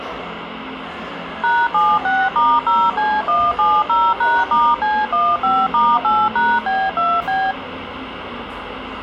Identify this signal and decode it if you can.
DTMF, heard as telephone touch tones, dialled by machine, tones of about 230 ms, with radio hiss and the noise of a crowd indoors. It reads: #76*0C170#*C15*8#B2B